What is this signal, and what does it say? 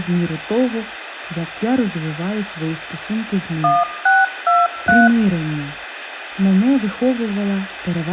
DTMF, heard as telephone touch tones, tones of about 200 ms, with radio hiss. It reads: 1623